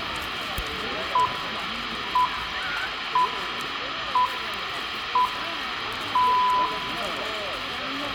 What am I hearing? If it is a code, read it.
Radio time signal (six pips, as the Greenwich Time Signal), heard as pips, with radio hiss, room echo and the noise of a park.